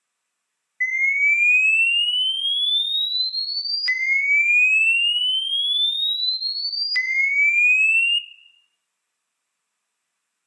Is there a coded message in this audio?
No, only a tone that sweeps in pitch again and again, with room echo.